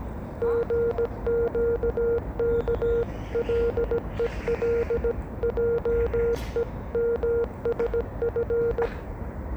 Morse code (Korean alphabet), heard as a keyed tone, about 17 wpm, 470 Hz, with the noise of a park. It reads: 생각하면